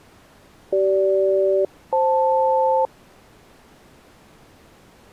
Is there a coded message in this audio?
Yes: aircraft SELCAL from 0.7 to 2.9 s, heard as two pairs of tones. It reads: CG-FL